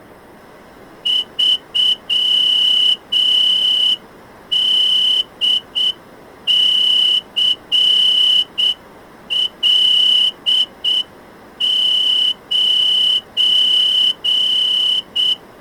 Morse code, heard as a whistle, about 7 wpm. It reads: 3DCL9